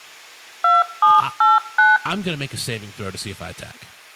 DTMF, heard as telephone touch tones, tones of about 180 ms, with room echo and speech in English. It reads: 2789